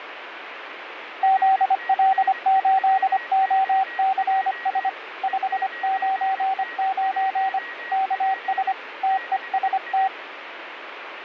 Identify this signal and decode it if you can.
Morse code, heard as a keyed tone, hand-sent with a paddle, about 25 wpm, 770 Hz, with radio static and a weaker station near 1900 Hz. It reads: ZL8OCS 599 KS TEST